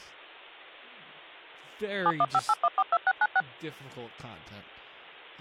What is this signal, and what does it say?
DTMF, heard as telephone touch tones, dialled by machine, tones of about 50 ms, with speech in English. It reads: 7158142696